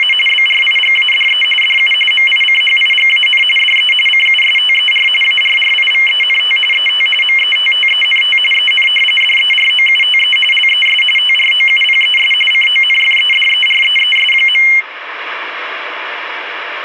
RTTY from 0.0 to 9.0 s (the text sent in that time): … BRIGADE DU MICHIGAN DE CUSTER ARRIVENT ET METTENT EN